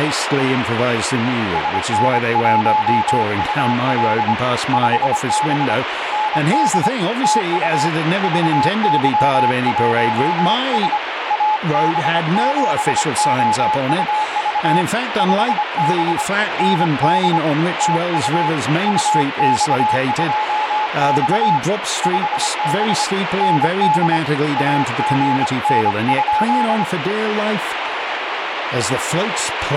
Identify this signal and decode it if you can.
Morse code, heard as a keyed tone, hand-sent with a paddle, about 25 wpm, 860 Hz, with heavy radio static and speech in English. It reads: SN1UL 5B ND TU VY1S AB7OUV 5B ND TU UX2X 5B ND AGN?